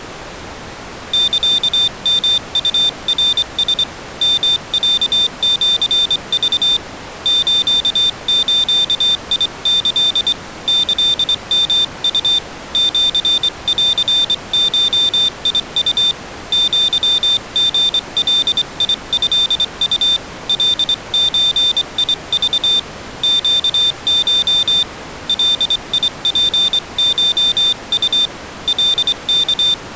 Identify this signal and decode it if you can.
Morse code (Japanese Wabun code), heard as a high beeper, hand-sent with a straight key, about 24 wpm, 3600 Hz. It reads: サヨウナラ ヨロシク スズキ キヨウ シンゴウ アリガトウ カゾク ネコ ガツコウ カワ